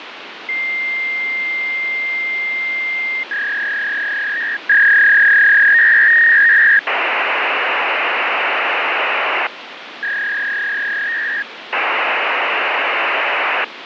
Fax machine handshake, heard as a long tone, a warble and hiss, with phone line noise.